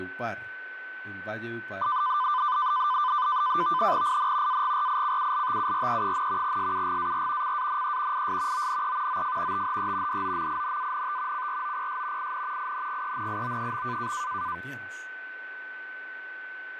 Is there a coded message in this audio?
Yes: NAVTEX (SITOR-B), 100 baud, 170 Hz shift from 1.8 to 14.6 s, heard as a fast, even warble, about 1100 Hz centre, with radio static, fading, a steady whistle near 1510 Hz and speech in Spanish. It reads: IN AGRICULTURE, SUGAR CANE IS ONE OF THE DOMINANT CROPS IN INGENIO.